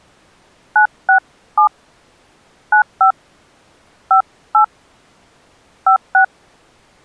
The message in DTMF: 967 95 58 56

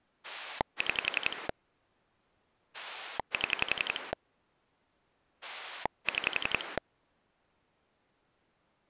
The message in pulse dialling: 6 7 6

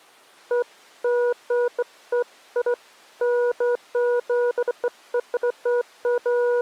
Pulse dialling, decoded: none

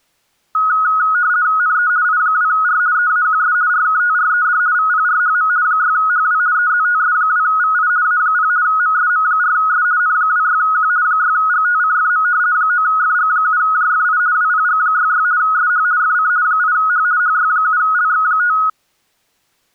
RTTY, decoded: NE I2R EAQS RKTRED VPRHM 6HW EZTS2VI A0 MSM4S N26Q 6GTCFM 9FG7JFI WPG66 SH FC 8H HY7LX5

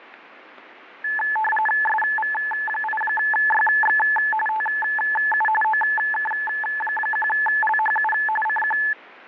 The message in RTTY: SV8YX TU OK1LHU CQ

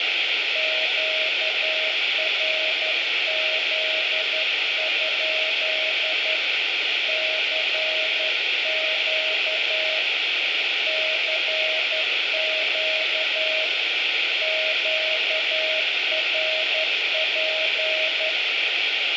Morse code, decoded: QRZ? CQ CQ QRP

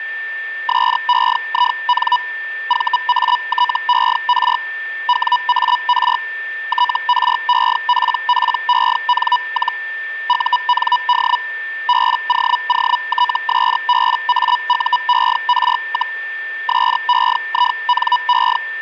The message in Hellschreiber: SEIN VATER WAR TREPPEN- UND BOOTSBAUER, SEINE

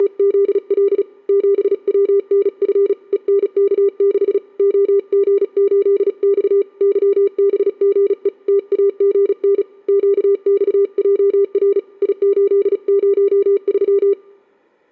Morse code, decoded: … 7WNF ENK6 OG8X YBGE TAGN QXJR I803

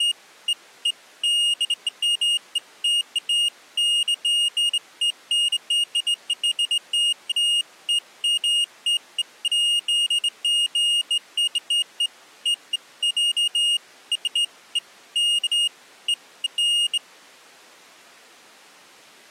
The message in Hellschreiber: none

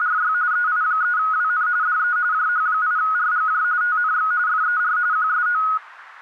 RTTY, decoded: … EI3WN DE JH8RGJ TNX FER QSO

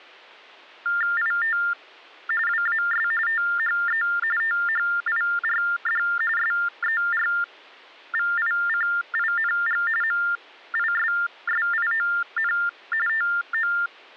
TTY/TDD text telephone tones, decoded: IT WAS THE THIRD SERVICING MISSION TO

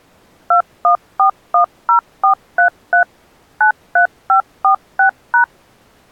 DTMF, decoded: 21410433 93546#

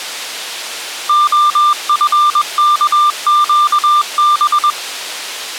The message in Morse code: OFKQB

